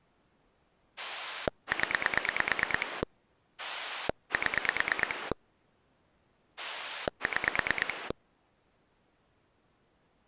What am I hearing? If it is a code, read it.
Pulse dialling, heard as a rotary dial, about 9 pulses a second. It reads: 0 7 6